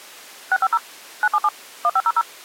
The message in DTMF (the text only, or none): 650 977 1500